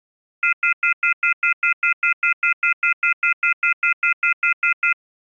Telephone call progress tone (North American plan), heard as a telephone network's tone, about 1400, 2050, 2450, 2600 Hz, 0.1 s on and 0.1 s off. Off-hook warning tone.